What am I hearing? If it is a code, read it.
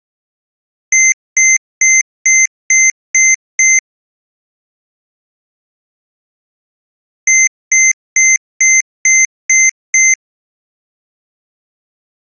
Beep code, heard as beeps from a small speaker, played twice, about 2100 Hz. 7 short. In AMI BIOS tables: virtual mode exception error; in Dell tables: processor failure.